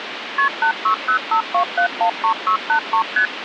Multi-frequency trunk signalling (R1, as on North American trunks), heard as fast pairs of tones, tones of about 90 ms, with phone line noise. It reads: KP 86052713683 ST